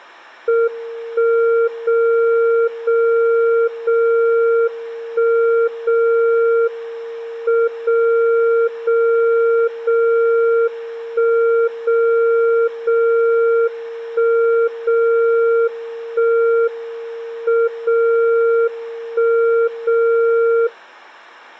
Radio time signal (WWVB), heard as a tone whose level steps once a second, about 460 Hz. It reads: 1 0 0 0 1 0 M 0 0 0 1 0 0 1 0 1 M 0 1 0